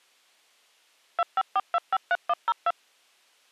DTMF, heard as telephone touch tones, dialled by machine, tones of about 40 ms. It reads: 254253102